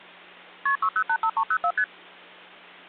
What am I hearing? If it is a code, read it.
Multi-frequency trunk signalling (R1, as on North American trunks), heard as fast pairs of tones, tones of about 70 ms, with hum. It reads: KP 6085304 ST